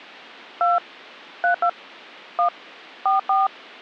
DTMF, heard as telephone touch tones, dialled by hand, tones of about 130 ms. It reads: 2 32 1 44